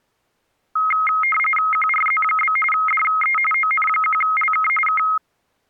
RTTY (45.45 baud, 850 Hz shift), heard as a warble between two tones, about 1700 Hz centre. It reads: QRZ? DE ON1LK K